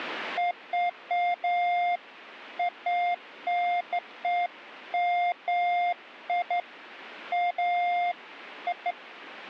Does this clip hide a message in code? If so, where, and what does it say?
No, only beeps of irregular length.